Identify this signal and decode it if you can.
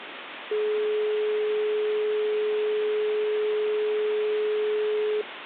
Telephone call progress tone (425 Hz plan, as in most of Europe), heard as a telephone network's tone, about 420 Hz, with phone line noise. Dial tone.